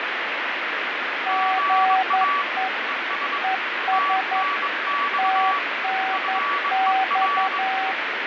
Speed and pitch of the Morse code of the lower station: 11 wpm, 760 Hz

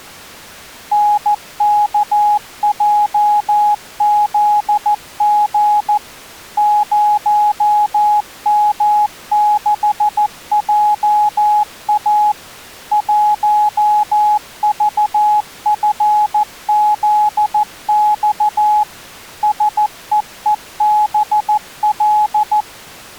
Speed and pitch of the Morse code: 14 wpm, 840 Hz

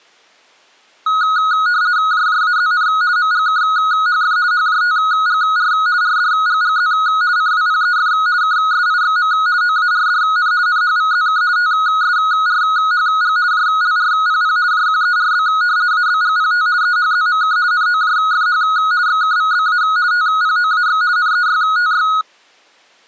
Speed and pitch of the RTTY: 50 baud, 170 Hz shift, 1360 Hz centre

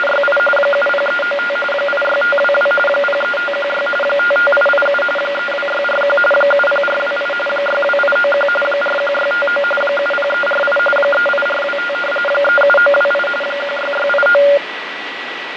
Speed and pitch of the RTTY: 45.45 baud, 850 Hz shift, 990 Hz centre

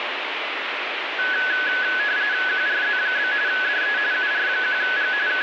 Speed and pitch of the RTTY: 45.45 baud, 170 Hz shift, 1600 Hz centre

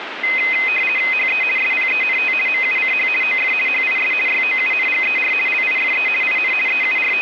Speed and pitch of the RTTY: 50 baud, 450 Hz shift, 2300 Hz centre

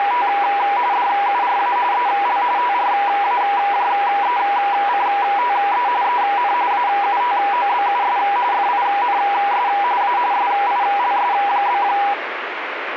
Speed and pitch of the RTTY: 45.45 baud, 170 Hz shift, 890 Hz centre

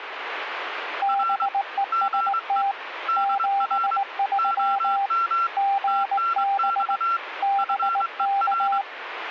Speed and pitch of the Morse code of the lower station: 19 wpm, 790 Hz

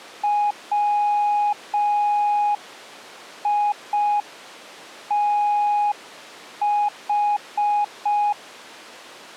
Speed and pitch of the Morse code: 5 wpm, 830 Hz

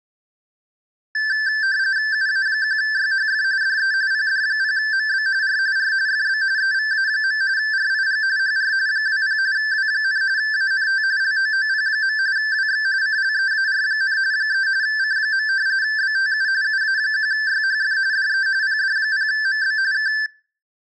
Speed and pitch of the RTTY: 45.45 baud, 170 Hz shift, 1650 Hz centre

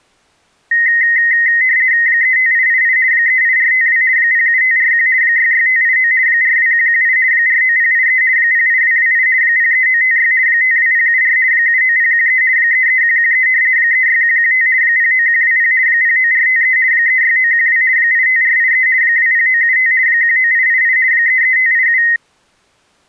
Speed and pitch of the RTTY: 50 baud, 170 Hz shift, 1950 Hz centre

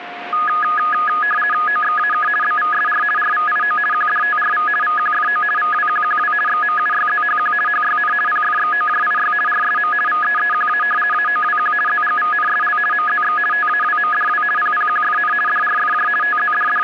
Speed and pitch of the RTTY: 50 baud, 450 Hz shift, 1460 Hz centre

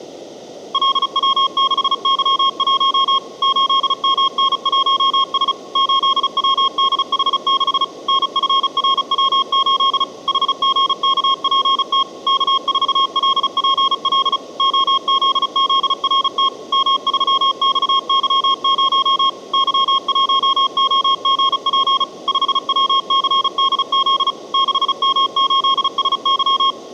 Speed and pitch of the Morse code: 35 wpm, 1080 Hz

